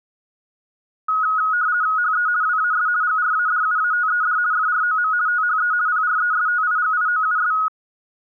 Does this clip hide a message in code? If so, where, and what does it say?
Yes: RTTY (50 baud, 170 Hz shift) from 1.1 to 7.7 s, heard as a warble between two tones, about 1360 Hz centre. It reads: HE WAS GRADUATED FROM THE PRESTIGIOUS